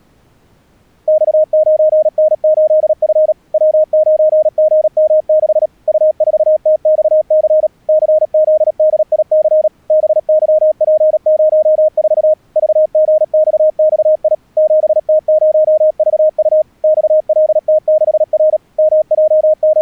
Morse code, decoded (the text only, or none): X9N8F W9GM6 U4TXC CZDIC BYP04 VGXXI 7T0VU XLT6R …